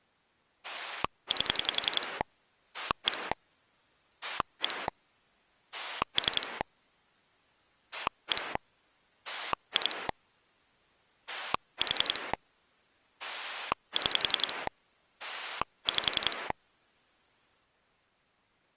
Pulse dialling, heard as a rotary dial, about 11 pulses a second. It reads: 8 1 1 3 1 2 4 6 5